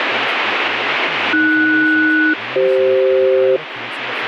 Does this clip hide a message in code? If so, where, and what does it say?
Yes: aircraft SELCAL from 1.3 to 3.6 s, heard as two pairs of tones, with radio static and speech in English. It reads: AS-CF